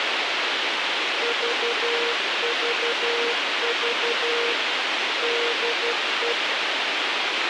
Morse code, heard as a keyed tone, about 12 wpm, 470 Hz, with radio hiss and a squelch burst at the end. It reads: VVV DE